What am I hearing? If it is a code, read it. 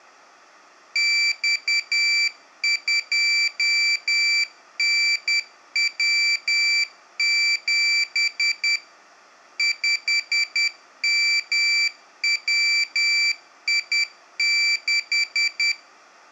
Morse code, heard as a high beeper, machine-sent, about 10 wpm, 2350 Hz, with room echo. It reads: X2NW7 5MWI6